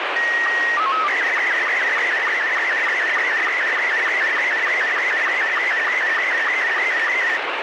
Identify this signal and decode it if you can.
SSTV (slow-scan television), Robot 72, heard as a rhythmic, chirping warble, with heavy radio static.